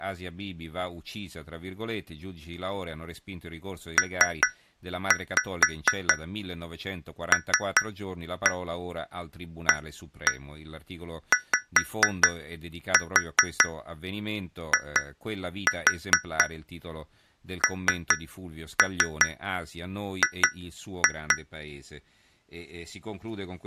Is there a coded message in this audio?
Yes: tap code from 4.0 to 21.5 s, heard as taps on glass, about 4 knocks a second, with speech in Italian. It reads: PLAYING